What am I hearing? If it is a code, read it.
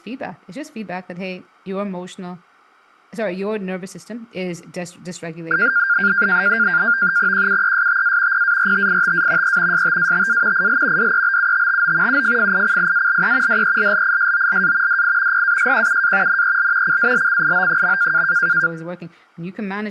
NAVTEX (SITOR-B), 100 baud, 170 Hz shift, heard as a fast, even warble, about 1500 Hz centre, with speech in English. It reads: QUESTA PARTITA E STATA IL DEBUTTO UFFICIALE DELLISOLA DI PASQUA NEL CALCIO.